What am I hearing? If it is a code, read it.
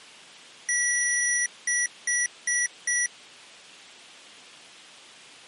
Beep code, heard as beeps from a small speaker, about 1950 Hz. 1 long, 4 short.